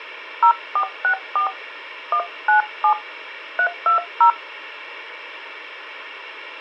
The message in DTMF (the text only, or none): 0464 197 320